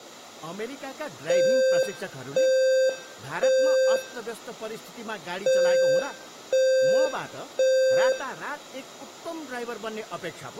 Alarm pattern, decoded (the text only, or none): temporal three